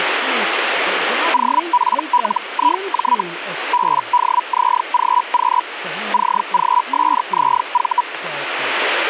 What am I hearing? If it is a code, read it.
Hellschreiber (Feld-Hell, 122.5 baud), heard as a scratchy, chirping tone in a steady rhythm, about 980 Hz, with radio static and speech in English. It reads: OPLIJ BDZGQ CGSZV